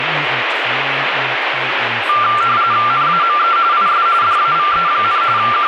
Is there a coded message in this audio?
Yes: RTTY (45.45 baud, 170 Hz shift) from 2.1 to 5.7 s, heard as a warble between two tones, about 1280 Hz centre, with radio static. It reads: NAME IS DAVE, …